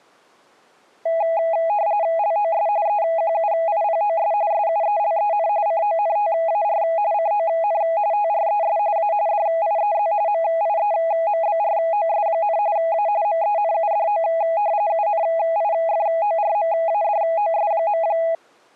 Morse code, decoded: none

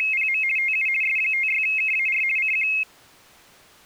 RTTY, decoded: … TU S56KAR CQ

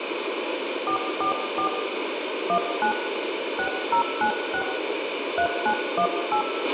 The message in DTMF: 444 19 6096 3918

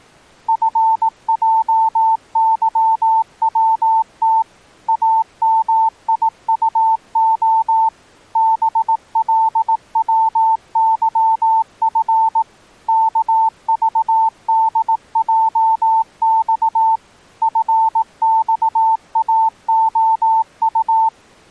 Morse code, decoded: FJYWT AMIUO BLWYF KVDJX FXAOU

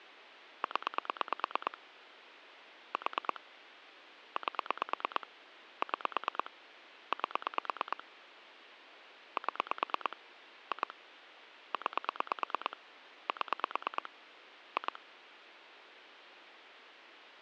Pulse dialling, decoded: 0 4 8 6 8 7 2 9 7 2

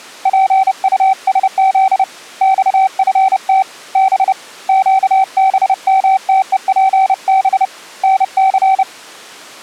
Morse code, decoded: PUSZ XFT B QBMTEPB NC

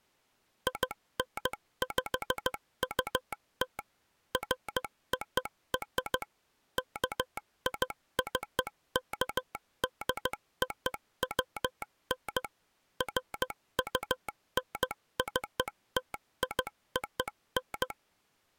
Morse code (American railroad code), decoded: INPUT FOR KICKDOWN FUNCTION

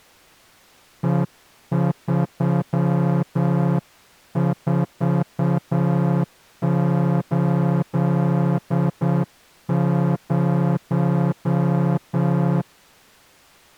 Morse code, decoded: E3480

